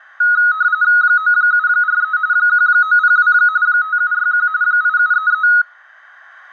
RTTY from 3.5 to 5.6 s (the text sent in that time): 5761 8733